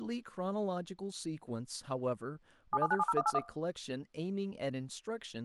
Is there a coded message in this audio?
Yes: DTMF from 2.7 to 3.4 s, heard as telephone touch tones, dialled by machine, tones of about 40 ms, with room echo and speech in English. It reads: 77970181